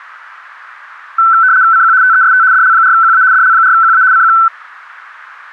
RTTY (75 baud, 170 Hz shift), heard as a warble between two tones, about 1420 Hz centre. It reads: CQ TEST DL4QA DL4QA CQ